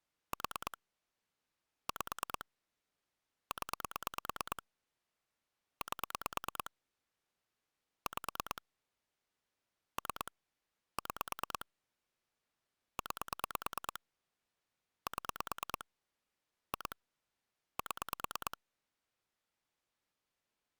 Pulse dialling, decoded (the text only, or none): 4 5 0 8 5 3 6 9 7 2 7